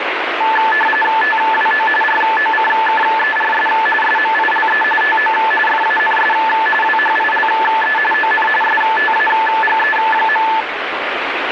RTTY (45.45 baud, 850 Hz shift), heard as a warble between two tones, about 1310 Hz centre, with radio static. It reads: TWO ROCKERS SMILE TO FANS WHILE ON STAGE.